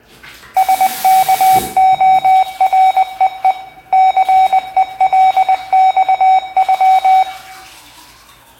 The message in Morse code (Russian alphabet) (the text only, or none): СКОРЕЕ ЦЕЛЬЮ